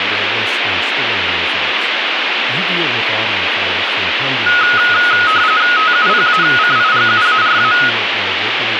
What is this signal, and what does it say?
RTTY (45.45 baud, 170 Hz shift), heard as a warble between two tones, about 1360 Hz centre, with radio static and speech in English. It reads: TUPACIGUARA